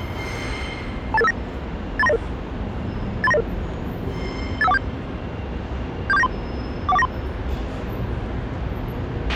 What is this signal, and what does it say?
Five-tone selective call (EIA), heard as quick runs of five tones, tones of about 30 ms, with a squelch burst at the end and the noise of a subway station. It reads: 28859 83900 83900 85147 74793 41493